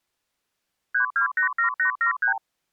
Multi-frequency trunk signalling (R2, with the far end's replies), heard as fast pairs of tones, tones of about 110 ms. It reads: 3287873